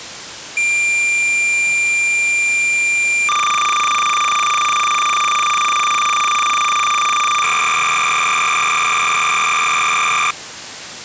Cassette data (Kansas City type), 300 baud, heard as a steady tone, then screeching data.